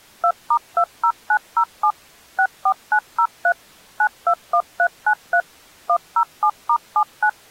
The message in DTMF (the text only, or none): 2*20907 64903 921393 107*79